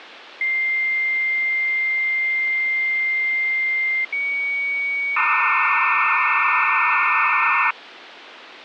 Dial-up modem handshake (low-speed, two carriers), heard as two whistles, then hiss, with phone line noise.